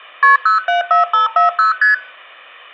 Multi-frequency trunk signalling (R1, as on North American trunks), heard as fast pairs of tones, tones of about 130 ms. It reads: KP 074540 ST